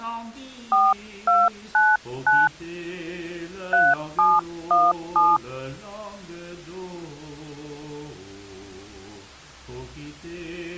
DTMF, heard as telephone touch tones, dialled by hand, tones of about 210 ms. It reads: 4299 3717